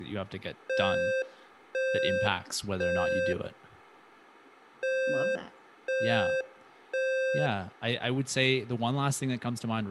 Alarm pattern, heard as an alarm's beeps, played twice, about 520 Hz, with room echo and speech in English. Temporal three. Smoke or fire, evacuate.